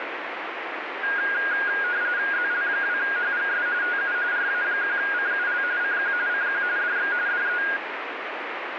RTTY (45.45 baud, 170 Hz shift), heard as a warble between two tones, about 1550 Hz centre, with radio static. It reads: ZL2HGS TU RA1CUL CQ CQ DX DE